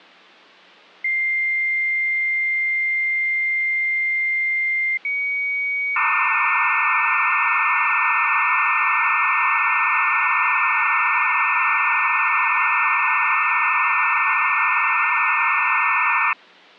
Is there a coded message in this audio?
Yes: dial-up modem handshake (low-speed, two carriers) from 1.0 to 16.3 s, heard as two whistles, then hiss.